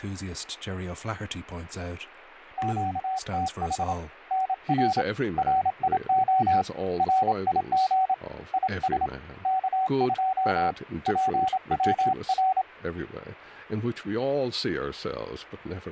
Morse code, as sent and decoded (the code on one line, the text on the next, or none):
--.- - .... / -. .-. / .-. .. --- / .-. .. --. / .. ... / -.- ..--- / .--. .-- .-.
QTH NR RIO RIG IS K2 PWR